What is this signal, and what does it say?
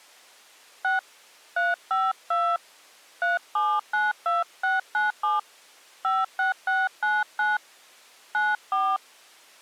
DTMF, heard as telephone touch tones, dialled by hand, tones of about 180 ms. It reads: 6 352 3792697 56699 94